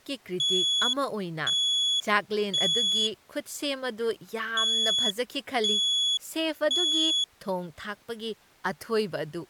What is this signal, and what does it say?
Alarm pattern, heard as an alarm's beeps, played twice, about 3400 Hz, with speech in Manipuri. Temporal three. Smoke or fire, evacuate.